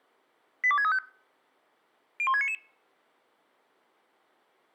Five-tone selective call (ZVEI), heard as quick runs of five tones, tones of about 70 ms. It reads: 82635 01699